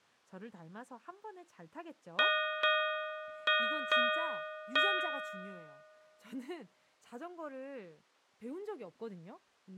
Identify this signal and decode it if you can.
Ship's bell, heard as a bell, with speech in Korean. 5. Five half-hours of the watch have passed.